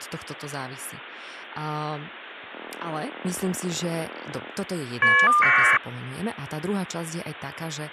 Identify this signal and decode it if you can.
Caller ID data burst, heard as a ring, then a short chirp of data, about 1200 baud, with phone line noise and speech in Slovak.